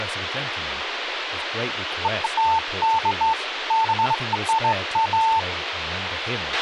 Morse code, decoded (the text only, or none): none